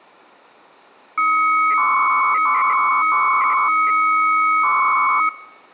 300-baud modem data (Bell 103 tones), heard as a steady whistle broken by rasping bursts, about 300 baud, 200 Hz shift.